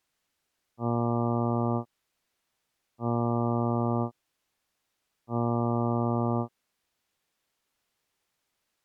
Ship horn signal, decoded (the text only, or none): 3 short